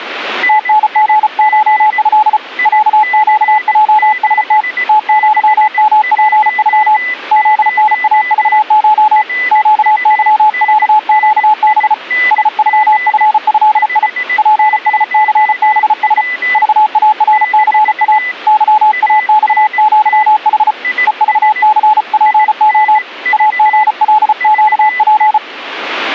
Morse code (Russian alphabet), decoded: ТНГШЭ ЯЩЙСТ ТЪМПЮ ЗНАЖШ ЩЫЯЩБ СЮФЭИ ПСЦБС ЖАРЦА ЫАЬЪХ ЕЖЦПО АГЛЩП

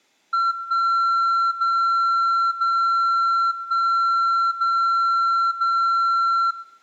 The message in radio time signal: 1 0 0 1 0 0

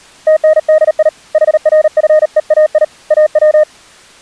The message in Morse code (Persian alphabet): تندی حرفهای او

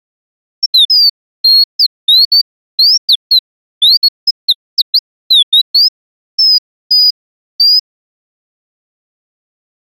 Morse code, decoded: none

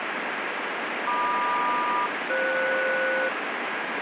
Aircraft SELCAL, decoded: MQ-FS

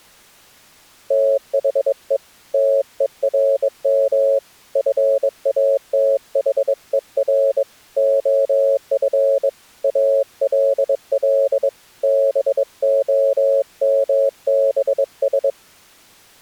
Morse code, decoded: THE TERM FATHER OF ALL BOMBS

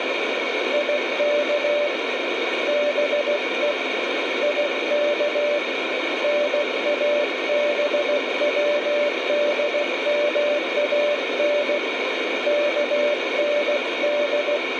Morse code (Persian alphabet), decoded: یک به یک نابودمان کند

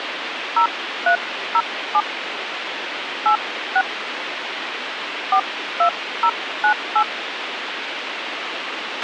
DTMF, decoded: 0307 86 42098

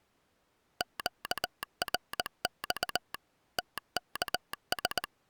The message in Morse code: QRX TKS

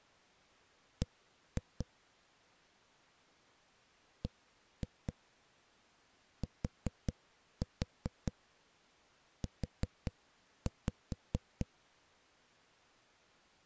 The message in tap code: B BTU

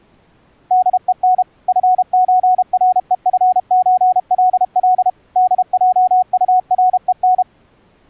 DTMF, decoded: none

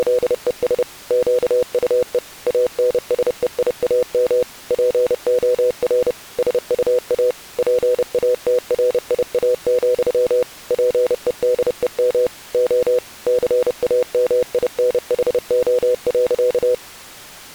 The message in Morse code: … QUE ANSEIAM POR SUA PATRIA, PEDEM O CAMINHO.

